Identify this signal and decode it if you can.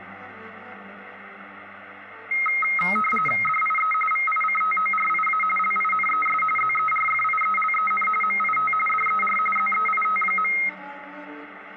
RTTY (45.45 baud, 850 Hz shift), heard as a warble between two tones, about 1700 Hz centre, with radio static. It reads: DIE VICTORIA LINES ZERFIELEN MIT DER ZEIT.